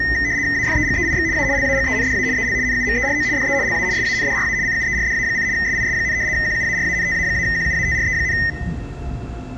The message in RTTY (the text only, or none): AFEGEIX A LAGENDA EL NUMERO DE LA SANDRA CUERDA: SIS, QUARANTA-QUATRE,